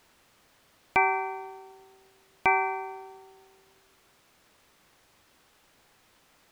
Clock strike, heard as a bell. 2. Two o'clock.